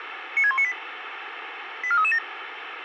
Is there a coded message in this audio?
Yes: five-tone selective call (ZVEI) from 0.4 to 2.2 s, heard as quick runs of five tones, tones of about 70 ms, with radio hiss. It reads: 96198 84337